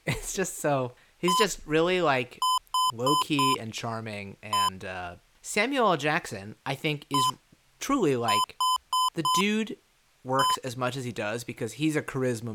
Beep code, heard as beeps from a small speaker, played twice, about 1020 Hz, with speech in English. 1-4-1. In Phoenix BIOS tables: address line failure in the first 64 KB of memory.